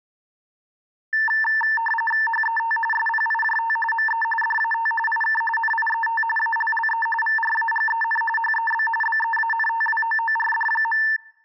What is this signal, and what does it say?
RTTY (45.45 baud, 850 Hz shift), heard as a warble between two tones, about 1340 Hz centre. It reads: HET SPIJT ME DAT IK NIET ALLE VRAGEN HEB BEANTWOORD.